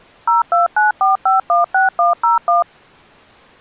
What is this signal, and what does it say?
DTMF, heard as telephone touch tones, dialled by machine, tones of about 140 ms. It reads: 0294516101